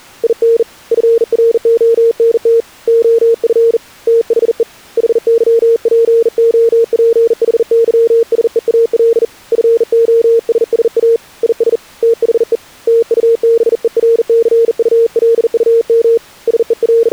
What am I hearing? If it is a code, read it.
Morse code, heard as a keyed tone, hand-sent with a bug key, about 40 wpm, 460 Hz. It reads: IN FRONT OF THE HYPOPHYSEAL FOSSA IS THE TUBERCULUM …